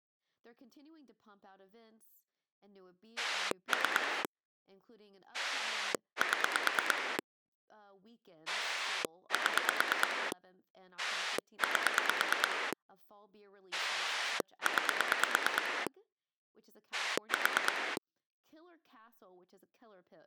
Pulse dialling, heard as a rotary dial, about 9 pulses a second, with speech in English. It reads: 3 7 7 8 9 4